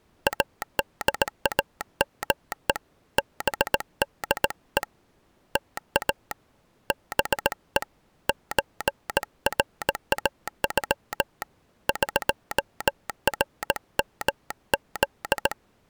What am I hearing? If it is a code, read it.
Morse code (Persian alphabet), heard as a telegraph sounder, hand-sent with a paddle, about 18 wpm. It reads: ادامه بده تا به چراغ قرمز